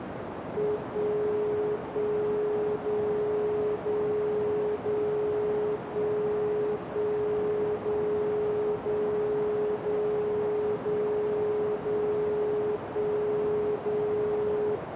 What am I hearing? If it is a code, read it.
Radio time signal (DCF77), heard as a tone whose level steps once a second, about 420 Hz, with radio static and a narrow filter. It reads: 1 1 0 0 0 1 1 0 0 0 0 0 1 0